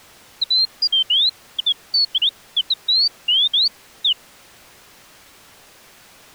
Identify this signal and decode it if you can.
Bird-like chirps. There is no code.